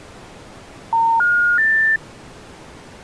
Telephone call progress tone (North American plan), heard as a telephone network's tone, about 910, 1430, 1800 Hz. Special information tone.